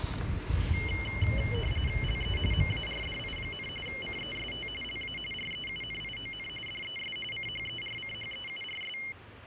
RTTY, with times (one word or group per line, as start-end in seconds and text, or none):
2.0-2.4 LE
2.5-3.7 MARDI,
3.9-4.7 CEST
4.8-5.2 LA
5.3-6.5 REUNION
6.7-7.2 DES
7.3-9.0 CHERCHEURS